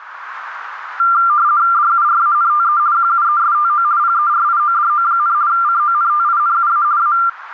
RTTY (50 baud, 170 Hz shift), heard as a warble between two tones, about 1280 Hz centre, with radio static and a narrow filter. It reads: DURANTE QUESTO PERIODO, CONTINUA A